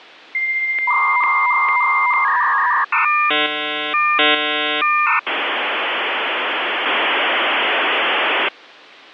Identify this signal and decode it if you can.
Dial-up modem handshake (V.34 or later), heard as a whistle, warbles, then hiss.